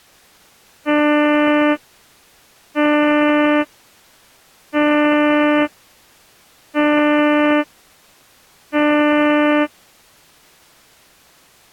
Ship horn signal, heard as a ship's horn, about 300 Hz. 5 short. At sea: I doubt that you are doing enough to avoid a collision.